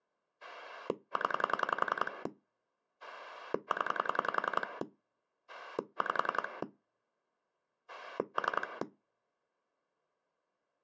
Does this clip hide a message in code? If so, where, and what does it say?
Yes: pulse dialling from 0.4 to 8.8 s, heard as a rotary dial, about 10 pulses a second. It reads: 0 0 5 3